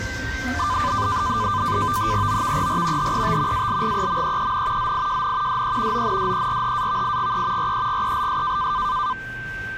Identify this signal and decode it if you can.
NAVTEX (SITOR-B), 100 baud, 170 Hz shift, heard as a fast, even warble, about 1100 Hz centre, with a steady whistle near 1560 Hz and the noise inside a lift. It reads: OVER HET ALGEMEEN ZIJN DE ONDERHAVIGE REGELS